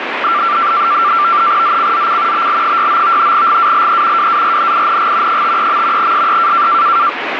NAVTEX (SITOR-B), 100 baud, 170 Hz shift, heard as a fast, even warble, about 1270 Hz centre, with radio static. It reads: ZCZC BL69 GALE WARNING 53. SE